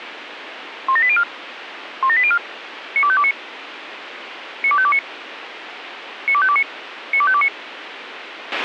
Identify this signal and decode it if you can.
Five-tone selective call (ZVEI), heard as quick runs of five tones, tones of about 70 ms, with radio hiss and a squelch burst at the end. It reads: 17804 17804 92529 92529 92529 92529